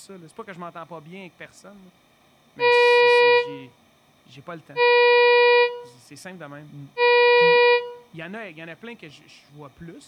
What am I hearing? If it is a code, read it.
Ship horn signal, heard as a ship's horn, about 480 Hz, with room echo and speech in French. 3 short. At sea: I am operating astern propulsion.